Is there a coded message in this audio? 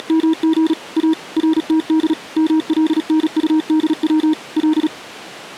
Yes: Morse code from 0.0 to 4.9 s, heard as a keyed tone, machine-sent, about 36 wpm, 320 Hz. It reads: … A RTD MLNUDW L